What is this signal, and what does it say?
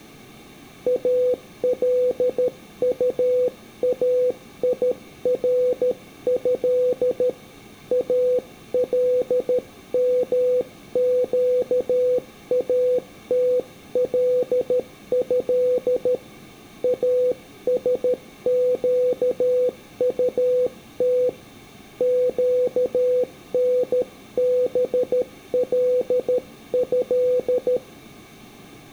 Morse code (Arabic alphabet), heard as a keyed tone, hand-sent with a paddle, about 13 wpm, 500 Hz. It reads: الطايره المقاتله اسقطت قنبله